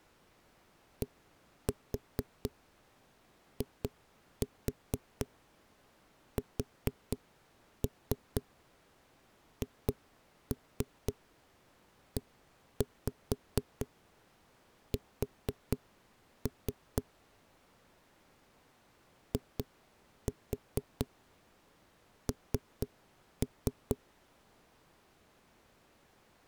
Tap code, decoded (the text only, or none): DISHES IN